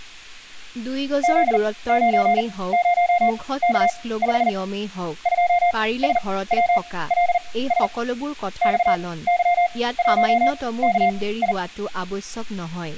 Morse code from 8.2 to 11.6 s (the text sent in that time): XY1KI